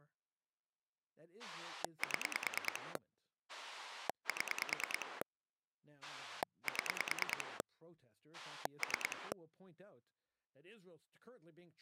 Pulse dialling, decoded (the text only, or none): 7 7 7 3